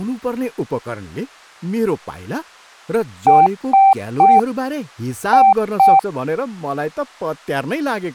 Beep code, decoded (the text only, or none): 3-2